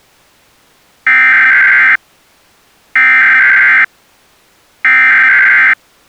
Emergency Alert System (SAME) tones (header bursts), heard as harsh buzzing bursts, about 520.83 baud.